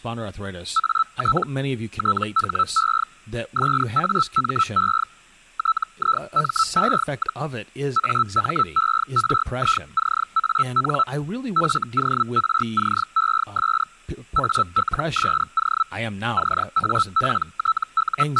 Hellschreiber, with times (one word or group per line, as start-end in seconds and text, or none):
0.8-1.4 AT
2.0-3.0 THE
3.6-5.0 SAME
5.6-7.4 TIME,
8.0-11.0 AMERICAN
11.6-13.8 FORCES
14.4-15.8 ALSO
16.4-18.4 …